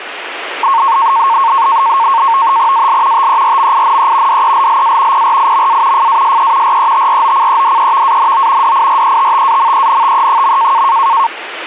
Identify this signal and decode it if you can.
NAVTEX (SITOR-B), 100 baud, 170 Hz shift, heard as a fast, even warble, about 1000 Hz centre, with radio static. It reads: AL TERMINE DELLA PRIMA FASE RETROCEDEVANO DIRETTAMENTE.